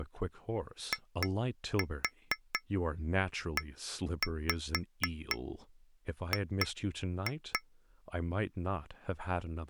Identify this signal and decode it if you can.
Tap code, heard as taps on glass, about 4 knocks a second, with speech in English. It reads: IEG